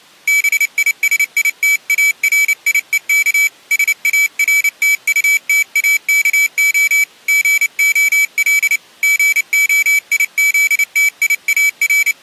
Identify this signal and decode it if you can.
Morse code, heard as a high beeper, hand-sent with a paddle, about 29 wpm, 2300 Hz. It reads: BISITARIEK SARTUTAKO GOL …